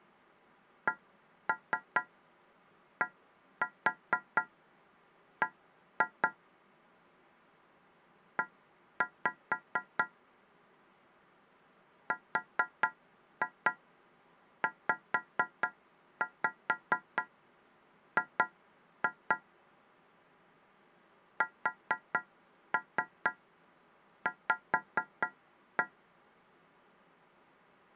Tap code, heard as taps on a metal pipe, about 4 knocks a second. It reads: CDB E RZG SV